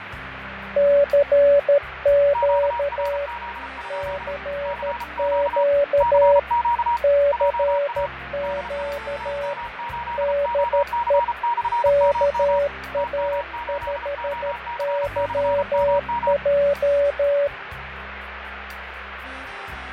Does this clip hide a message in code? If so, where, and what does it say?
Yes: Morse code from 0.7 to 17.5 s, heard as two keyed tones, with radio static and fading. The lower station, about 13 wpm, 570 Hz: CQ CQ CQ DE KA5YJ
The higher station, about 33 wpm, 950 Hz: QRZ? CQ CQ JA DE TM8OC/MM TM8OC/MM